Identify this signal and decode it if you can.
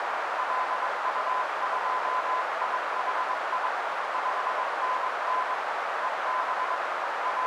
Morse code, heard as a keyed tone, hand-sent with a paddle, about 22 wpm, 1020 Hz, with heavy radio static and a narrow filter. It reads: LU2IHI 5NN EB …